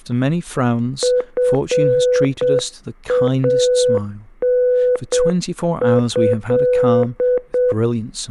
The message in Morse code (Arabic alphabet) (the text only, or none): فانه